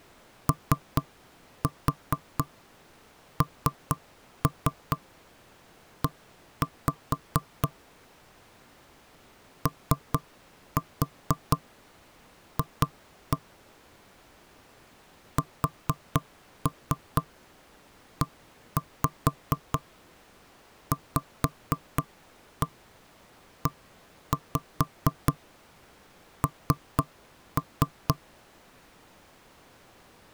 Tap code, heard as knocks on wood, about 4 knocks a second. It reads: ONE OF SEVEN